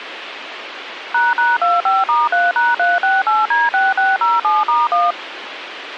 DTMF, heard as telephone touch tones, dialled by machine, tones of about 190 ms, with radio hiss. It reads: ##25*3#368D6607*1